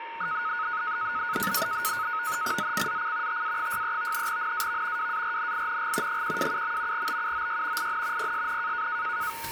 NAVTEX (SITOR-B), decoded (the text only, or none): ZCZC TA63 NAV WARNING 127. BUOY IN PSN